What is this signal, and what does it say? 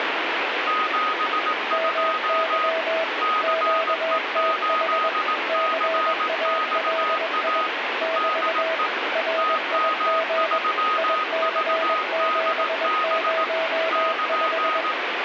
Morse code, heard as two keyed tones, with heavy radio static. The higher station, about 18 wpm, 1250 Hz: 72 CE8CXA DE TM3VDB <KN>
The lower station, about 21 wpm, 650 Hz: MY QTH CALI <BT> RIG IC705